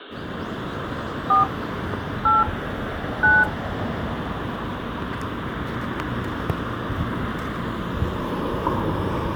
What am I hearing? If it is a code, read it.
DTMF, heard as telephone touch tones, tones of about 170 ms, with the noise of a residential street. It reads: 4 8 9